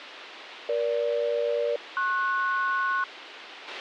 Aircraft SELCAL, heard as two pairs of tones, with radio hiss and a squelch burst at the end. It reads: EG-PS